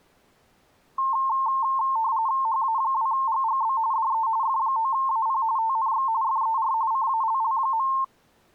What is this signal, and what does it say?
RTTY (45.45 baud, 170 Hz shift), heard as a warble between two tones, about 980 Hz centre. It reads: HA2GGB DE F9AP TNX FER CALL.